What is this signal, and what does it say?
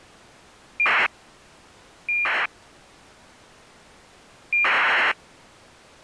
ACARS aircraft data, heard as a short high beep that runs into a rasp, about 2400 baud.